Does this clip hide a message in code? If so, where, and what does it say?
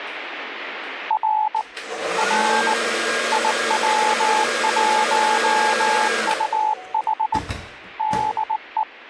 Yes: Morse code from 1.0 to 8.9 s, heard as a keyed tone, hand-sent with a bug key, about 19 wpm, 860 Hz, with the noise of a restroom. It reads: R R IW1UH DE